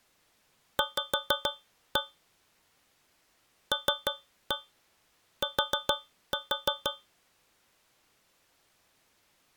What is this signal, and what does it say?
Tap code, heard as taps on a metal pipe, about 6 knocks a second. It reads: V LT